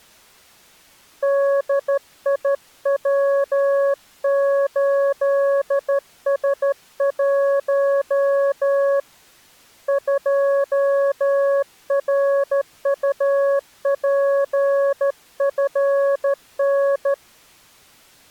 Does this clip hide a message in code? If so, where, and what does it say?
Yes: Morse code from 1.2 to 17.2 s, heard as a keyed tone, hand-sent with a straight key, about 13 wpm, 560 Hz. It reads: DIW8S1 2RUPFN